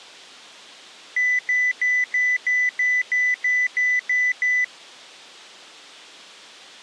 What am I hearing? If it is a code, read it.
Beep code, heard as beeps, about 2000 Hz. 11 short. In AMI BIOS tables: cache memory error.